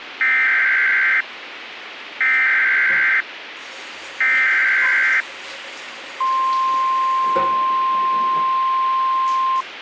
Emergency Alert System (SAME) tones (header bursts, then the 1050 Hz attention tone), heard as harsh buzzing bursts, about 520.83 baud, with radio hiss and the noise of a restroom.